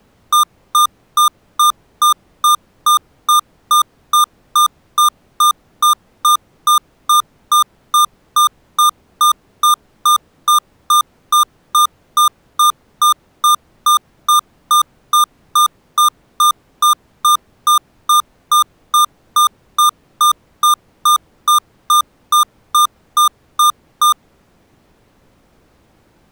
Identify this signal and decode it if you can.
Evenly repeated beeps. There is no code.